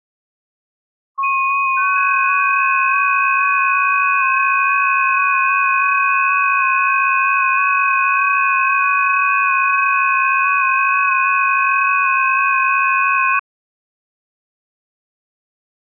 FT8 (several signals at once), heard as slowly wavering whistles, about 6.25 baud.